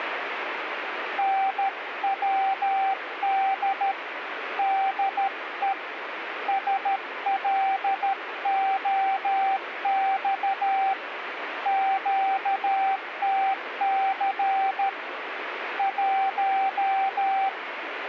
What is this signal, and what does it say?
Morse code, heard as a keyed tone, hand-sent with a paddle, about 13 wpm, 780 Hz, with radio static. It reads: NWD DE SLOX QTC 1